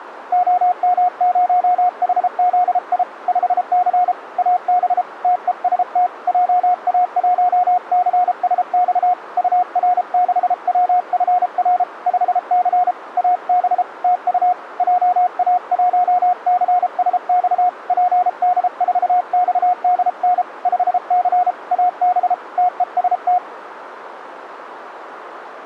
Morse code, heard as a keyed tone, hand-sent with a paddle, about 33 wpm, 720 Hz, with radio static. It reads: OM0HZI 5C AB TEST JA1CSX UR6WFR 5C AB TU JA1CSX PD4XDN 5C AB TEST